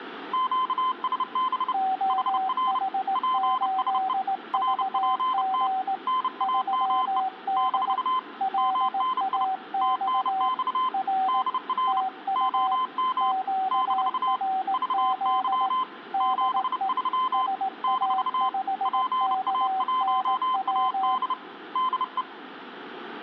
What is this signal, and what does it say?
Morse code, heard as two keyed tones. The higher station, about 30 wpm, 1030 Hz: QSB HR PSE RPT NAME - MNI TNX DR OM - VY 73 - PA1AD DE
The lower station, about 18 wpm, 760 Hz: OH8VG 3D LAX R TU QRZ DE SA5KNW